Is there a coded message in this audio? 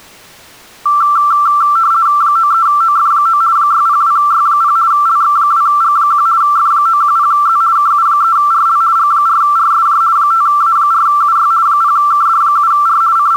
Yes: RTTY (50 baud, 170 Hz shift) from 0.9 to 13.4 s, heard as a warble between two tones, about 1260 Hz centre. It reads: 93OF9 602Y0 LX2G1 F910Z KU3RL G4RSJ 5A4UY 0KD7R …